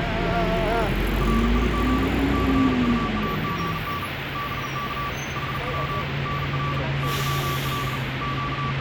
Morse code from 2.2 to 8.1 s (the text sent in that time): CUAGN BK HW NR YL